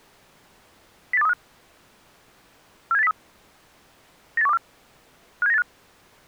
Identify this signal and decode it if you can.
Five-tone selective call (EEA), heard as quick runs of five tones, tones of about 40 ms. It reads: 08235 47803 98124 57985